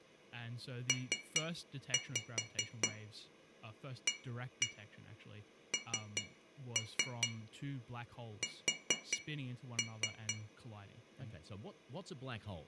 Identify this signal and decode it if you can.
Tap code, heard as taps on glass, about 4 knocks a second, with room echo and speech in English. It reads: PANS